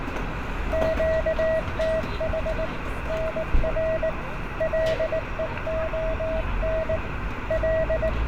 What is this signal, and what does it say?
Morse code, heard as a keyed tone, hand-sent with a paddle, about 19 wpm, 640 Hz, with radio static, room echo and street noise. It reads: QTH NR LEON …